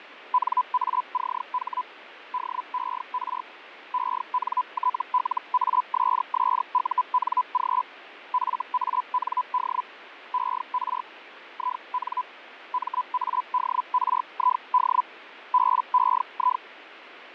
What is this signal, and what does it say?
Hellschreiber (Feld-Hell, 122.5 baud), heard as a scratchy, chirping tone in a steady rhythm, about 1000 Hz, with radio static and fading. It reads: NACH DER ENTLASSUNG FAND ER IN MADRID BEI